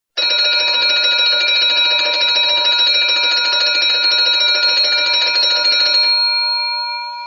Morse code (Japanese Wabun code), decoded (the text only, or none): none